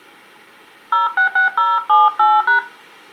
DTMF, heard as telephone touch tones, dialled by hand, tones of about 160 ms. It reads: 066078#